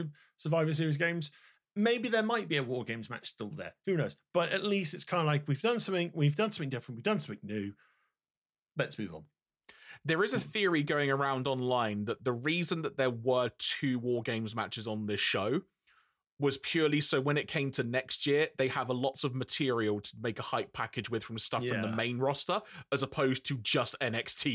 Speech in English. There is no code.